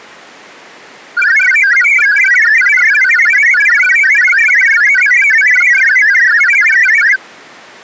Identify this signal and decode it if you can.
Multi-tone FSK (Olivia or MFSK type), about 1000 Hz wide, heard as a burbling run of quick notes, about 62.5 baud.